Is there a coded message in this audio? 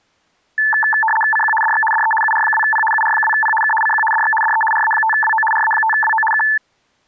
Yes: RTTY (75 baud, 850 Hz shift) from 0.6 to 6.6 s, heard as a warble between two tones, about 1310 Hz centre. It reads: CQ DX DE UR2P UR2P K CQ DX DE RA5WO RA5WO K